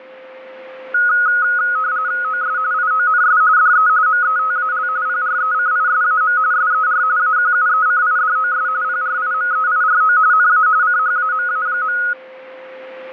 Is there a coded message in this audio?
Yes: RTTY (45.45 baud, 170 Hz shift) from 0.9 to 12.1 s, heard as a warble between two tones, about 1360 Hz centre, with a steady whistle near 520 Hz. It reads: OS IONS DE METAL PRECISAM SER AQUECIDOS PRIMEIRO NA CHAMA.